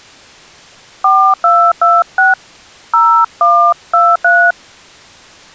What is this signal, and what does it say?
DTMF, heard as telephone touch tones, dialled by hand, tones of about 270 ms. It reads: 4226 0123